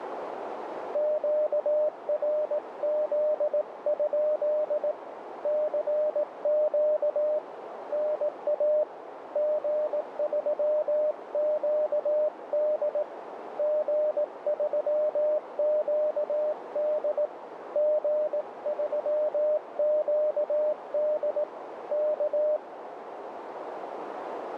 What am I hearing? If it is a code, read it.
Morse code, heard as a keyed tone, hand-sent with a paddle, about 18 wpm, 610 Hz, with radio static and a narrow filter. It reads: QRZ? CQ NA G3QD G3QD G3QD K